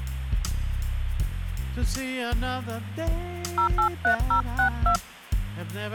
DTMF, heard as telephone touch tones, dialled by hand, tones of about 100 ms, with hum. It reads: 083062